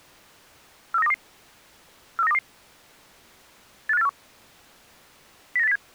Five-tone selective call (EEA), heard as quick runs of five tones, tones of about 40 ms. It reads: 43922 43922 85841 09807